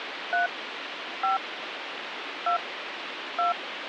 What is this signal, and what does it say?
DTMF, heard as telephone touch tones, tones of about 160 ms, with phone line noise. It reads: 3 5 2 2